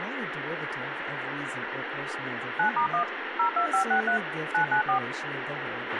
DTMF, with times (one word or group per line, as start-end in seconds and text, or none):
2.6-3.0 9*1
3.4-4.2 02563
4.5-5.0 994